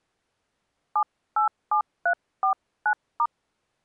DTMF, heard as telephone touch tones, dialled by hand, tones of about 90 ms. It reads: 787349*